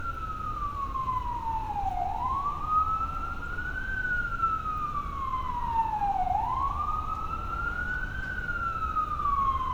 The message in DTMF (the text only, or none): none